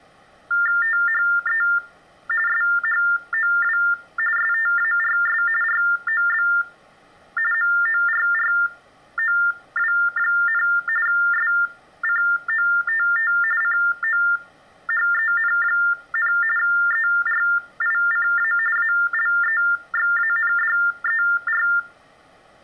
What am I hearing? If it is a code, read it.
TTY/TDD text telephone tones (45.45 baud Baudot), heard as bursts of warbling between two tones, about 400 Hz shift, 1600 Hz centre. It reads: THE SHOW STARS ROB MORROW, SCOTT COHEN, ERICA ALEXANDER